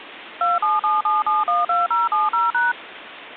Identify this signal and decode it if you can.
DTMF, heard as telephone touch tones, dialled by machine, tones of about 170 ms, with phone line noise. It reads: 2777712070#